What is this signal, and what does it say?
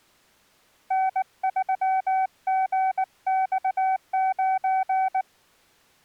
Morse code, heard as a keyed tone, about 19 wpm, 760 Hz. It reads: N3GX9